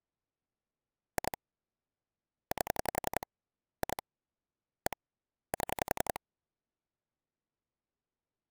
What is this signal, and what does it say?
Pulse dialling, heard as clicks on a phone line, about 11 pulses a second. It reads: 2 8 2 1 7